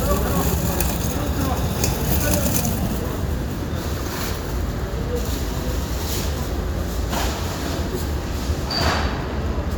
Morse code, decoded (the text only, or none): none